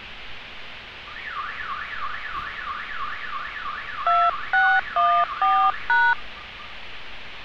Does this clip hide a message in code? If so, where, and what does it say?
Yes: DTMF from 4.1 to 6.1 s, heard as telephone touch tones, dialled by hand, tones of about 240 ms, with street noise. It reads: 2614#